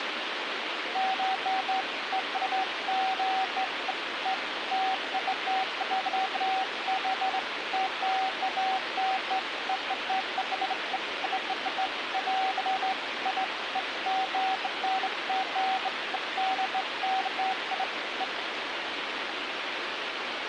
Beeps of irregular length, with radio hiss. There is no code.